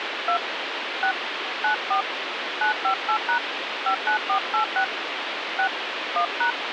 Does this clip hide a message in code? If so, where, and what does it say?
Yes: DTMF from 0.3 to 6.5 s, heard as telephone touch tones, dialled by hand, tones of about 100 ms, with phone line noise. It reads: 2 6 94 958# 59486 6 1#